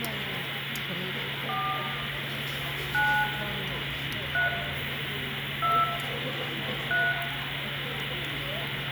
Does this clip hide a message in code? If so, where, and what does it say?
Yes: DTMF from 1.5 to 7.1 s, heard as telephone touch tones, dialled by hand, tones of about 210 ms, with phone line noise, room echo and the noise of a restaurant. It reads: 4 9 3 2 3